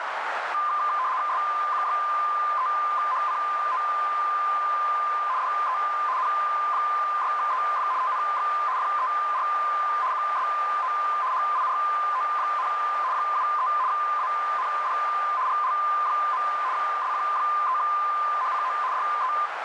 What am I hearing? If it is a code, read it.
RTTY (75 baud, 170 Hz shift), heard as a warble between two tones, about 1110 Hz centre, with radio static and a narrow filter. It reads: SQ3HCO DE N6EF TNX FER QSO HIRO, 73 AND GL. SQ3HCO DE